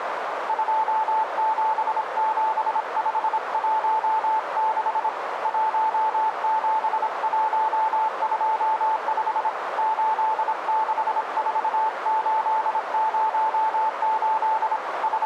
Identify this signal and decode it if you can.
Morse code, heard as a keyed tone, hand-sent with a paddle, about 26 wpm, 880 Hz, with radio static and a narrow filter. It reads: 277516 17125 864808 …